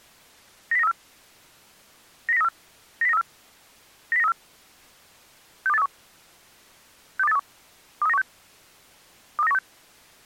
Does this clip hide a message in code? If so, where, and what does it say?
Yes: five-tone selective call (EEA) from 0.7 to 9.6 s, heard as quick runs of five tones, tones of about 40 ms. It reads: 90934 90934 90934 90934 62831 62831 23916 23916